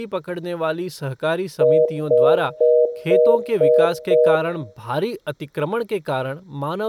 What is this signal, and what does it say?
Telephone call progress tone (North American plan), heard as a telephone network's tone, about 480, 620 Hz, 0.25 s on and 0.25 s off, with speech in Hindi. Congestion tone.